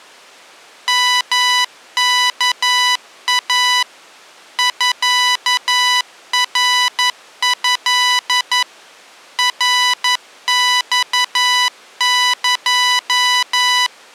Morse code (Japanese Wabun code), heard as electronic beeps, machine-sent, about 11 wpm, 990 Hz. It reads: ヨワイ ミナト ナマエ